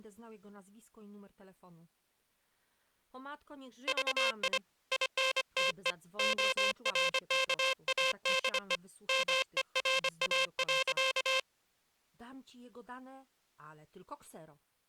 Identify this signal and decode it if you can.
Morse code, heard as a buzzer, hand-sent with a paddle, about 25 wpm, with speech in Polish. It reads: VI INTE ORKADE MERA.